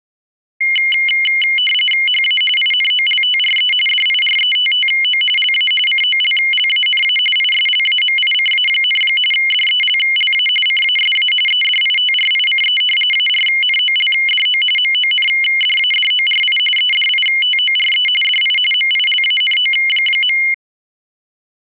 RTTY (45.45 baud, 850 Hz shift), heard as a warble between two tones, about 2550 Hz centre. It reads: HA INOLTRE DIRETTO LA COLLANA ISLAMICA, DELLA CASA EDITRICE ARNOLDO MONDADORI EDITORE DI MILANO.